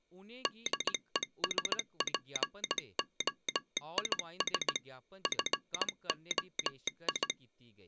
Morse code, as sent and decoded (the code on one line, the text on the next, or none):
-.. . ... .--. --- .. ... / ..-. --- ..
DESPOIS FOI